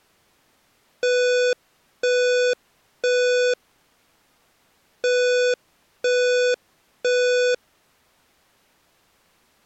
Alarm pattern, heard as an alarm's beeps, played twice, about 500 Hz. Temporal three. Smoke or fire, evacuate.